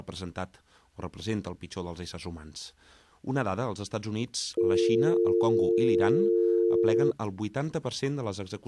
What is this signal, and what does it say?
Telephone call progress tone (North American or UK plan), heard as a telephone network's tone, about 350, 450 Hz. Dial tone.